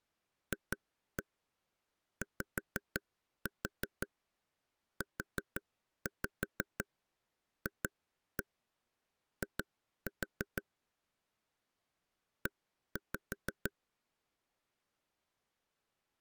Tap code, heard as taps on a table, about 6 knocks a second. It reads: FYUFI E